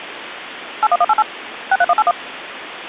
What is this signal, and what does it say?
DTMF, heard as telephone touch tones, dialled by machine, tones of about 40 ms, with phone line noise. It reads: 81188 63181